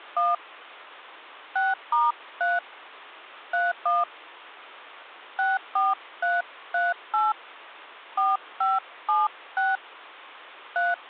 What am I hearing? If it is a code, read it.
DTMF, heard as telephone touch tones, dialled by hand, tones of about 180 ms. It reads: 1 6*3 31 64338 4576 3